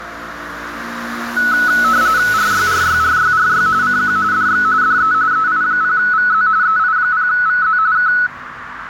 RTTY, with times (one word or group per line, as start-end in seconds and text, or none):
2.3-3.7 RYRYRYRY
3.8-4.2 CQ
4.3-4.6 DX
4.8-5.1 DE
5.3-6.5 EI0VZ
6.6-7.8 EI0VZ
7.9-8.1 K